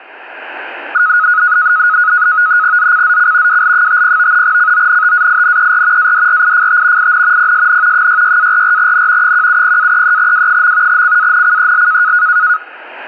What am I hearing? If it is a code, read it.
NAVTEX (SITOR-B), 100 baud, 170 Hz shift, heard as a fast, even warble, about 1360 Hz centre. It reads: ZCZC WL50 CONTAINER ADRIFT IN PSN 66-44N 170-33W. CANCEL